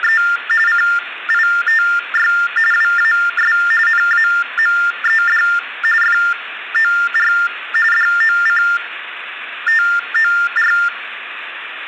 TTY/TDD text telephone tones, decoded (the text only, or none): … CITY WAS NAMED FOR DOCTOR